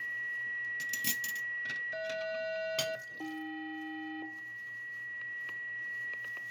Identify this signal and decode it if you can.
Aircraft SELCAL, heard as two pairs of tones, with static crashes, a steady whistle near 1930 Hz, room echo and kitchen noise. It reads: HS-AK